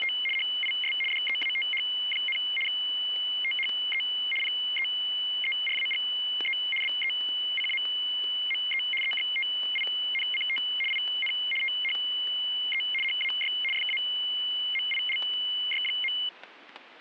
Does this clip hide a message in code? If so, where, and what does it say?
Yes: RTTY (75 baud, 850 Hz shift) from 0.0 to 16.3 s, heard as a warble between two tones, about 2550 Hz centre, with static crashes. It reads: … HIS DEATH, THE PEERAGE BECAME EXTINCT IN THE HAY FAMILY.